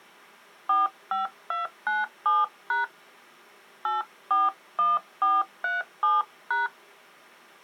DTMF, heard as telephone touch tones, dialled by hand, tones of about 170 ms. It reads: 45297# 841437#